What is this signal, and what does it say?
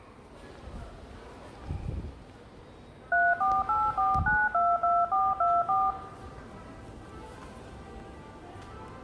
DTMF, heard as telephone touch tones, dialled by machine, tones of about 220 ms, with room echo and the noise of a subway station. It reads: 3484922424